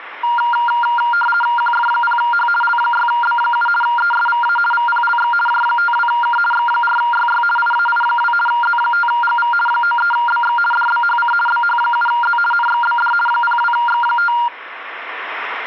RTTY (50 baud, 450 Hz shift), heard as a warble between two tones, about 1180 Hz centre. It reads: QF0H L6B7 ESVA VPLX J52K X4YY IAI2 Z5GV 93BX DBHC BH7Z NXBD 02X5